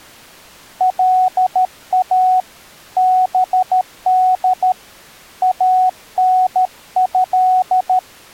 Morse code (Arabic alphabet), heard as a keyed tone, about 13 wpm, 740 Hz. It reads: لا بد انه